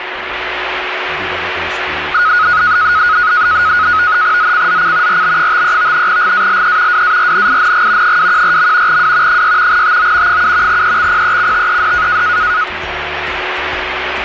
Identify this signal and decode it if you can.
NAVTEX (SITOR-B), 100 baud, 170 Hz shift, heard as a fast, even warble, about 1360 Hz centre, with radio static and a steady whistle near 370 Hz. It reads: ZCZC RB53 GALE WARNING 214. W 6 TO 7 EXPECTED